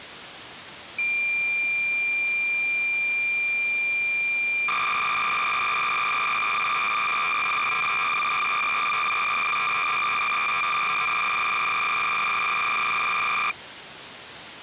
Cassette data (Kansas City type), 300 baud, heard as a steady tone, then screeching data, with tape hiss.